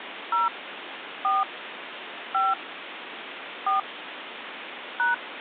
DTMF, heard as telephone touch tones, dialled by hand, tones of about 140 ms, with phone line noise. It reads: 0 4 5 4 #